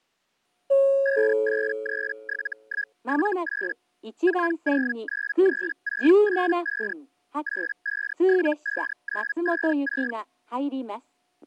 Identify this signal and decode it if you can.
Hellschreiber (Feld-Hell, 122.5 baud), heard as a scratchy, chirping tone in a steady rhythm, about 1650 Hz. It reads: 5837178 4093685 8575956